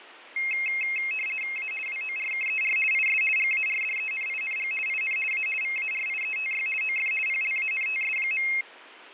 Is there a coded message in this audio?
Yes: RTTY (50 baud, 450 Hz shift) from 0.4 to 8.6 s, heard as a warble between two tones, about 2350 Hz centre, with radio static and fading. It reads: A WORKER IS GARDENING IN A VARIETY OF PLANTS.